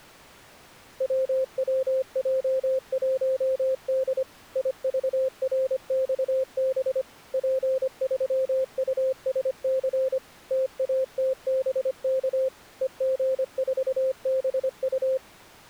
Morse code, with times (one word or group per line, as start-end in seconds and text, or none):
1.0-4.2 WWJ1D
4.6-7.0 IVRXB
7.3-10.2 P3USC
10.5-12.5 TATBK
12.8-15.2 EG4BU